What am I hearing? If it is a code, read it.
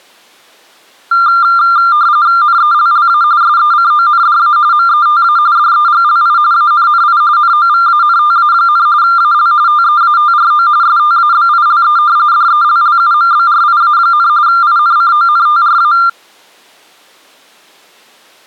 RTTY (45.45 baud, 170 Hz shift), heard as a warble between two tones, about 1290 Hz centre. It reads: NELLA SECONDA META DEGLI ANNI NOVANTA, AL TEATRO STABILE DELLUMBRIA, INCONTRA